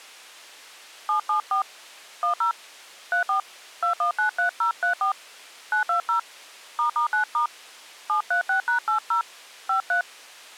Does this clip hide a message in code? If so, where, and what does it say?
Yes: DTMF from 1.1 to 10.0 s, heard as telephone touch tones, dialled by hand, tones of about 110 ms. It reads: 774 10 34 2193034 920 **9* 736#80 53